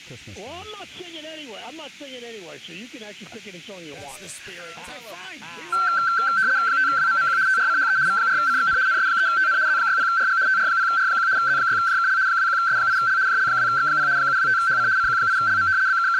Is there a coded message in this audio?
Yes: RTTY (75 baud, 170 Hz shift) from 5.7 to 16.2 s, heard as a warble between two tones, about 1450 Hz centre. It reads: 5WMMQ TRCHE V4CXN NS3TN Z60RG TR0R1 Z6JKL 21S8L JL2X0 725HC CQ8LM …